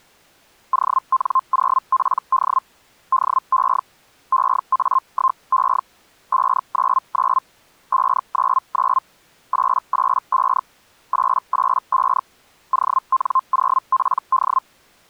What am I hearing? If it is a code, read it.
Hellschreiber (Feld-Hell, 122.5 baud), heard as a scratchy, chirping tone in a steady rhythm, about 1050 Hz. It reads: ON0PD DE EA1E 599 599 885 885 ON0PD